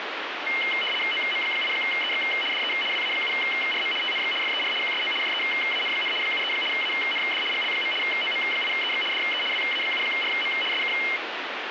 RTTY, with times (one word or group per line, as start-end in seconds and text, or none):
1.1-2.2 OM8EX
2.5-2.7 DE
2.9-3.9 WA7RM
4.0-4.3 TNX
4.4-4.7 FER
4.8-5.1 QSO
5.2-6.1 JEAN,
6.2-6.5 73
6.7-7.4 AND
7.5-7.9 GL.
8.0-9.0 OM8EX
9.1-9.4 DE
9.5-10.5 WA7RM
10.7-10.9 SK